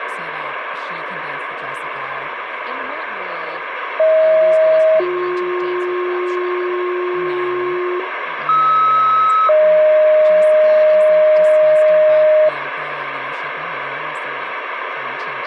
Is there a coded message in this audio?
Yes: two-tone page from 4.0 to 12.5 s, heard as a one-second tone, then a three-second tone, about 630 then 360 Hz, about 1290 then 620 Hz, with radio hiss and speech in English.